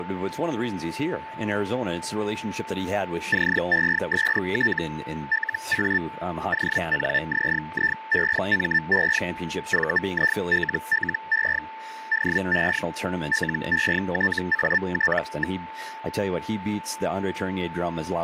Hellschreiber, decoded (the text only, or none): CEST LA ONZIEME VILLE DE LETAT.